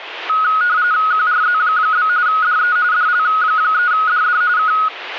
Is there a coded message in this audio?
Yes: RTTY (45.45 baud, 170 Hz shift) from 0.3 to 4.9 s, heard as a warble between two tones, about 1360 Hz centre. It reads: QRZ? DE DL3DD K